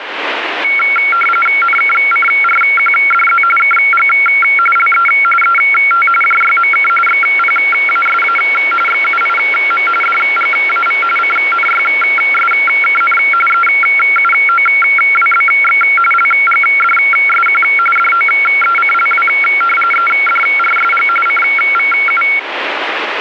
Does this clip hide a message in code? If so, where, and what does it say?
Yes: RTTY (45.45 baud, 850 Hz shift) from 0.6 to 22.4 s, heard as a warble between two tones, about 1800 Hz centre, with radio static. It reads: NKCRQDZ KG LE ET JYMK XPASA XUIM DGAV CNYSKN EUOWBX LGDSQ DOECLW EDRSG CVU